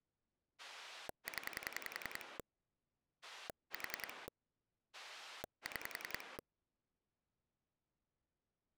Pulse dialling, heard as a rotary dial, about 10 pulses a second. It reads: 0 4 6